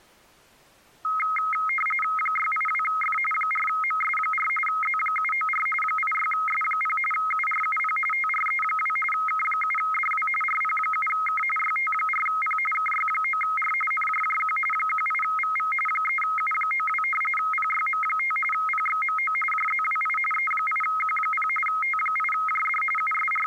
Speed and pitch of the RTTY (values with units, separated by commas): 45.45 baud, 850 Hz shift, 1700 Hz centre